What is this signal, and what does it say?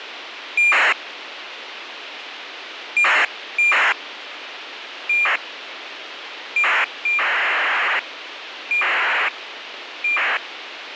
ACARS aircraft data, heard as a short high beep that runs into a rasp, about 2400 baud, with radio hiss.